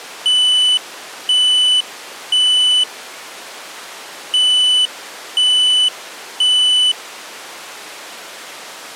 Alarm pattern, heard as an alarm's beeps, played twice, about 3000 Hz. Temporal three. Smoke or fire, evacuate.